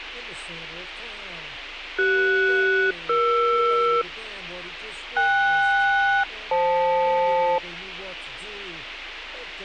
Aircraft SELCAL, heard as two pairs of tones, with a squelch burst at the end. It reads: CS-ER KS-FL